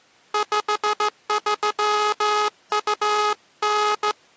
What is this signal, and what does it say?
Morse code (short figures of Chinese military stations), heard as a buzzer, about 14 wpm. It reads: 5329